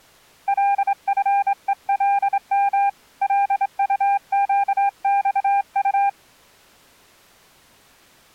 Morse code, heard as a keyed tone, hand-sent with a straight key, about 26 wpm, 800 Hz. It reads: LFELM LUQXU